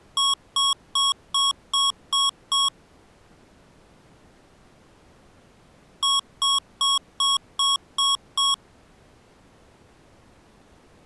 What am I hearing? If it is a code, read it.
Beep code, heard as beeps from a small speaker, played twice, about 1100 Hz. 7 short. In AMI BIOS tables: virtual mode exception error; in Dell tables: processor failure.